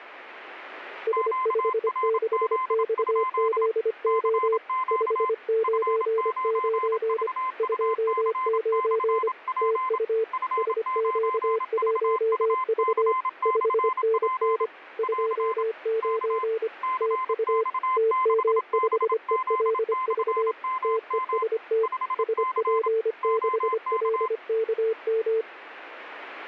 Morse code, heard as two keyed tones, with radio static. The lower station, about 25 wpm, 450 Hz: S56XZO 599 29 TU SQ1V 5NN 29 TU TM5ELV TEST SP6LKM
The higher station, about 27 wpm, 1030 Hz: QRZ? CQ F9VUC/P F9VUC/P <AR> K CX6BZ/MM 5C OK